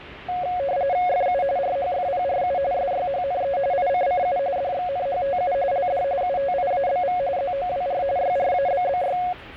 RTTY (45.45 baud, 170 Hz shift), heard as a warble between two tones, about 640 Hz centre, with the noise inside a subway train. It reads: FU RHFPRU SYHNE ICCU DXNHTU LD UTIABV ZOWR YRABBY